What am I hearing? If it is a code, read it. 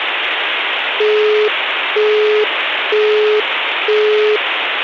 Telephone call progress tone (single-tone plan, as in Europe, Japan and elsewhere), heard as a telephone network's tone, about 420 Hz, 0.48 s on and 0.48 s off, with phone line noise. Busy tone.